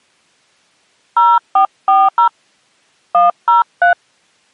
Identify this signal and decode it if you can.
DTMF, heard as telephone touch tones, dialled by hand, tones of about 180 ms. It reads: 0440 103